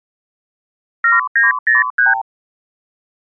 Multi-frequency trunk signalling (R2, with the far end's replies), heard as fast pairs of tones, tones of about 160 ms. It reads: 7903